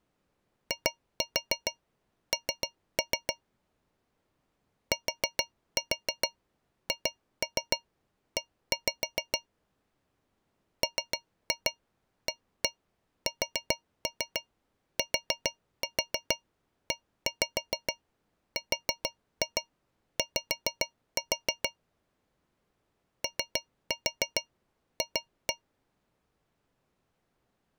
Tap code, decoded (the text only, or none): IN THE MASTERY OF